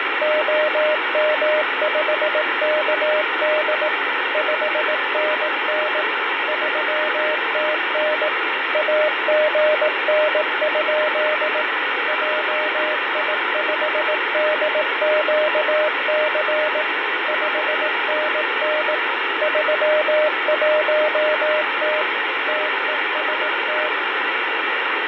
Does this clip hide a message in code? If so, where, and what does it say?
Yes: Morse code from 0.2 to 23.9 s, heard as a keyed tone, machine-sent, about 18 wpm, 610 Hz, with heavy radio static and fading. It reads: OM5KD 5NN 3TN AGN? JI5DQC 5NN 31T TEST